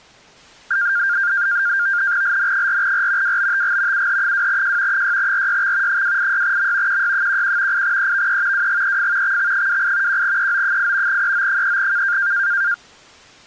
NAVTEX (SITOR-B), 100 baud, 170 Hz shift, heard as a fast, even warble, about 1500 Hz centre. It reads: LN4R WBTG UH2J 6RYX 286M QY11 8EVE WGEF XX28 1EO8 EO3K